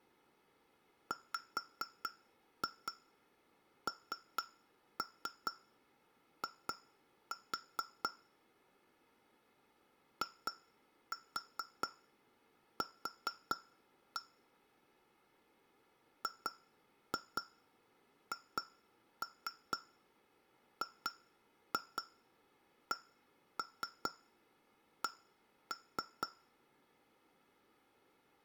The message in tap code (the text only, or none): WNI IQ GHGCC